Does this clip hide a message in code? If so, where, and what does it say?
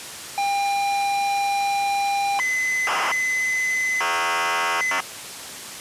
Yes: ZX Spectrum tape loading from 0.4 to 5.0 s, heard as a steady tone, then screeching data, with tape hiss.